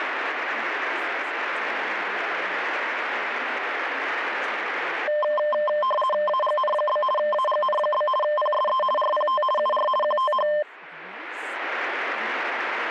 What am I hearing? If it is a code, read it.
RTTY (50 baud, 450 Hz shift), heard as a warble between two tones, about 820 Hz centre, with speech in English. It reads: AGN? AGN? PSE RPT UR QTH